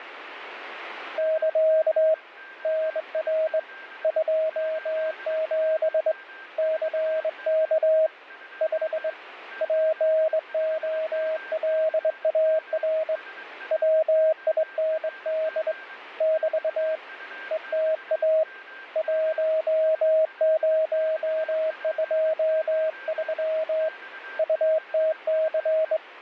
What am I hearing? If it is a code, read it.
Morse code, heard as a keyed tone, hand-sent with a straight key, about 22 wpm, 630 Hz, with radio static and a weaker station near 1580 Hz. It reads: <KA> NR 27 CK 5 POLAR WIND <BT> ETA 1023 UTC